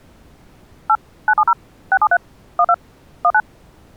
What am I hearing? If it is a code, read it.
DTMF, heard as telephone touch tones, dialled by machine, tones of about 60 ms. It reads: 8 970 673 12 19